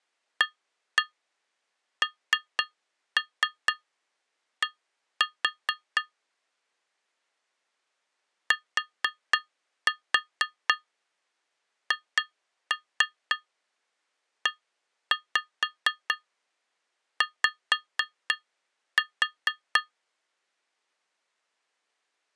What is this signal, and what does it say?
Tap code, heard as taps on glass, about 4 knocks a second. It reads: AND THEY